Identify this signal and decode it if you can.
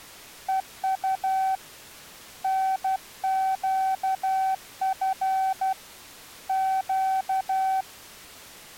Morse code, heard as a keyed tone, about 12 wpm, 760 Hz. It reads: EU NQF Q